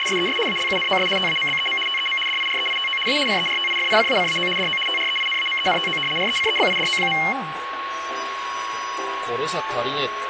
RTTY (75 baud, 850 Hz shift), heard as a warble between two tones, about 2550 Hz centre, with radio static and a steady whistle near 1100 Hz. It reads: … ALUNOS TAMBEM TEM DIREITO A CERTIFICACAO DO TREINAMENTO RECEBIDO.